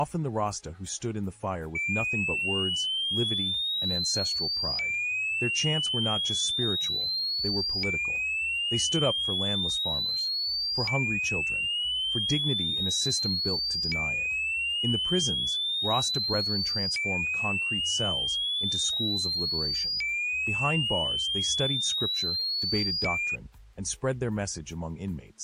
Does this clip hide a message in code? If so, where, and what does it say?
No, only a tone that sweeps in pitch again and again.